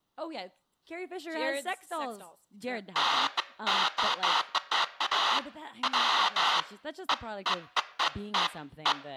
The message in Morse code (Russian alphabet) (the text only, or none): none